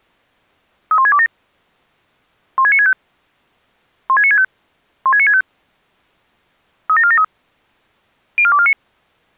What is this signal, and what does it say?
Five-tone selective call (ZVEI), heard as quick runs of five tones, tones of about 70 ms. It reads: 31627 16965 16965 16965 37473 04249